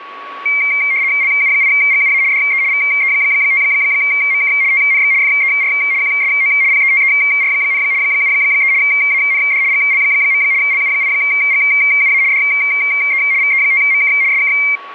RTTY (75 baud, 170 Hz shift), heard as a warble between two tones, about 2200 Hz centre, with a steady whistle near 1120 Hz. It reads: LU8GUA DE VE5MK TNX FER QSO PETER, 73 AND GL. LU8GUA DE VE5MK SK